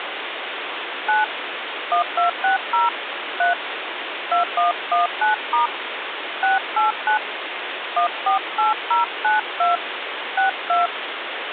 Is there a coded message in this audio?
Yes: DTMF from 1.1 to 10.9 s, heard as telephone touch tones, dialled by hand, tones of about 130 ms, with phone line noise. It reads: 9 1260 3 2119* 689 148092 62